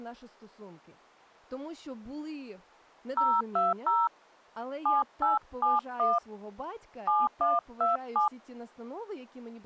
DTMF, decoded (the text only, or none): 020 7871 7127